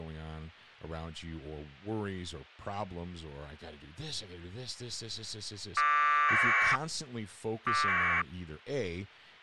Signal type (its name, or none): packet radio (AX.25, as in APRS)